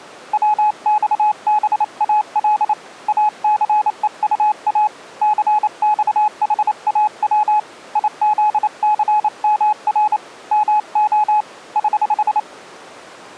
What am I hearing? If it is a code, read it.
Morse code, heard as a keyed tone, hand-sent with a paddle, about 28 wpm, 850 Hz. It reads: WXBAL ACEUA CXHAW IZCMR MO <HH>